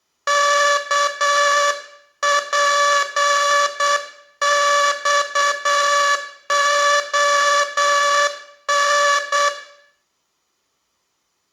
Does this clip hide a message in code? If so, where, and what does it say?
Yes: Morse code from 0.2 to 9.5 s, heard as a buzzer, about 8 wpm, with room echo. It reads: KPXON